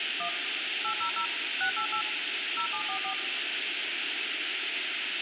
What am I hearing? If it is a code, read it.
DTMF, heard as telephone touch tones, dialled by machine, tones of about 90 ms, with radio hiss and room echo. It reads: 1 800 688 0744